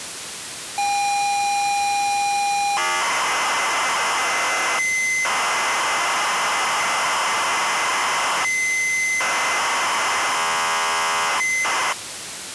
ZX Spectrum tape loading, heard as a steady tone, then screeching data, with tape hiss.